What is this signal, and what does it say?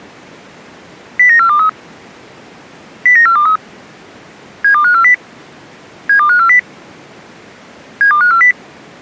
Five-tone selective call (CCIR), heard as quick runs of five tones, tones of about 100 ms. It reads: 09423 09423 72540 72540 72540